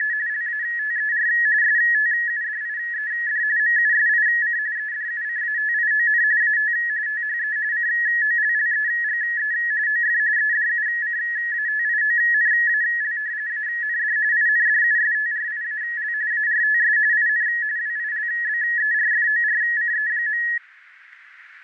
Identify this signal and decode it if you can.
RTTY (45.45 baud, 170 Hz shift), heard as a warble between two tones, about 1800 Hz centre, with radio static. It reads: … LATER STUDIED MUSIC EDUCATION AT THE COLLEGE OF EDUCATIONAL AND INDUSTRIAL ARTS IN WILBERFORCE.